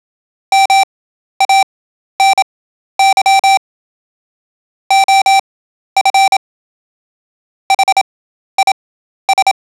Morse code, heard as electronic beeps, machine-sent, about 27 wpm, spaced as for 12 wpm, 780 Hz. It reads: MANY OF HIS